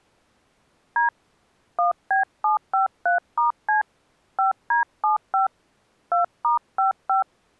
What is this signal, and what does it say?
DTMF, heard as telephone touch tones, dialled by hand, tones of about 130 ms. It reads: D 1B753*C 5D75 2*55